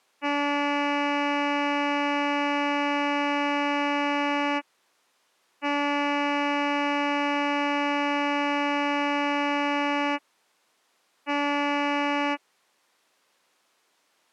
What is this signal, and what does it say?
Ship horn signal, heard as a ship's horn, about 290 Hz. 2 long, 1 short. At sea: I intend to overtake on your starboard side.